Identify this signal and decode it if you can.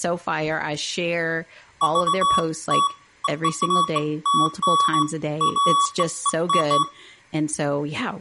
Beeps of irregular length, with room echo and speech in English. There is no code.